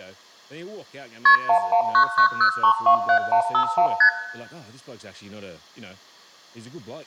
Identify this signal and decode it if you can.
Multi-frequency trunk signalling (R1, as on North American trunks), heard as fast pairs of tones, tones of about 90 ms, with room echo and speech in English. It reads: KP 11990327151 ST